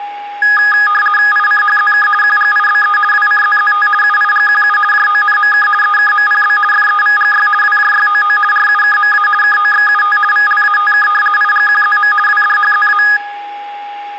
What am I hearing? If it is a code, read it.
RTTY (50 baud, 450 Hz shift), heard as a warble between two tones, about 1450 Hz centre, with a steady whistle near 820 Hz and room echo. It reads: ICHZK QGIBE WCZZT UIGQU JONMK EKMPB FEVGY WJYOO RUKMA KOXUT VLATK IGQZM WDHZA